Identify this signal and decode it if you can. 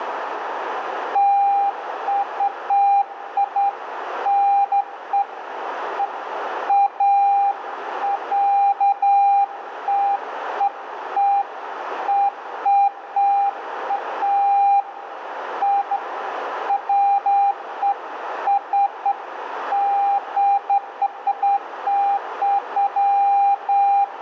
Beeps of irregular length, with radio static, a narrow filter and room echo. There is no code.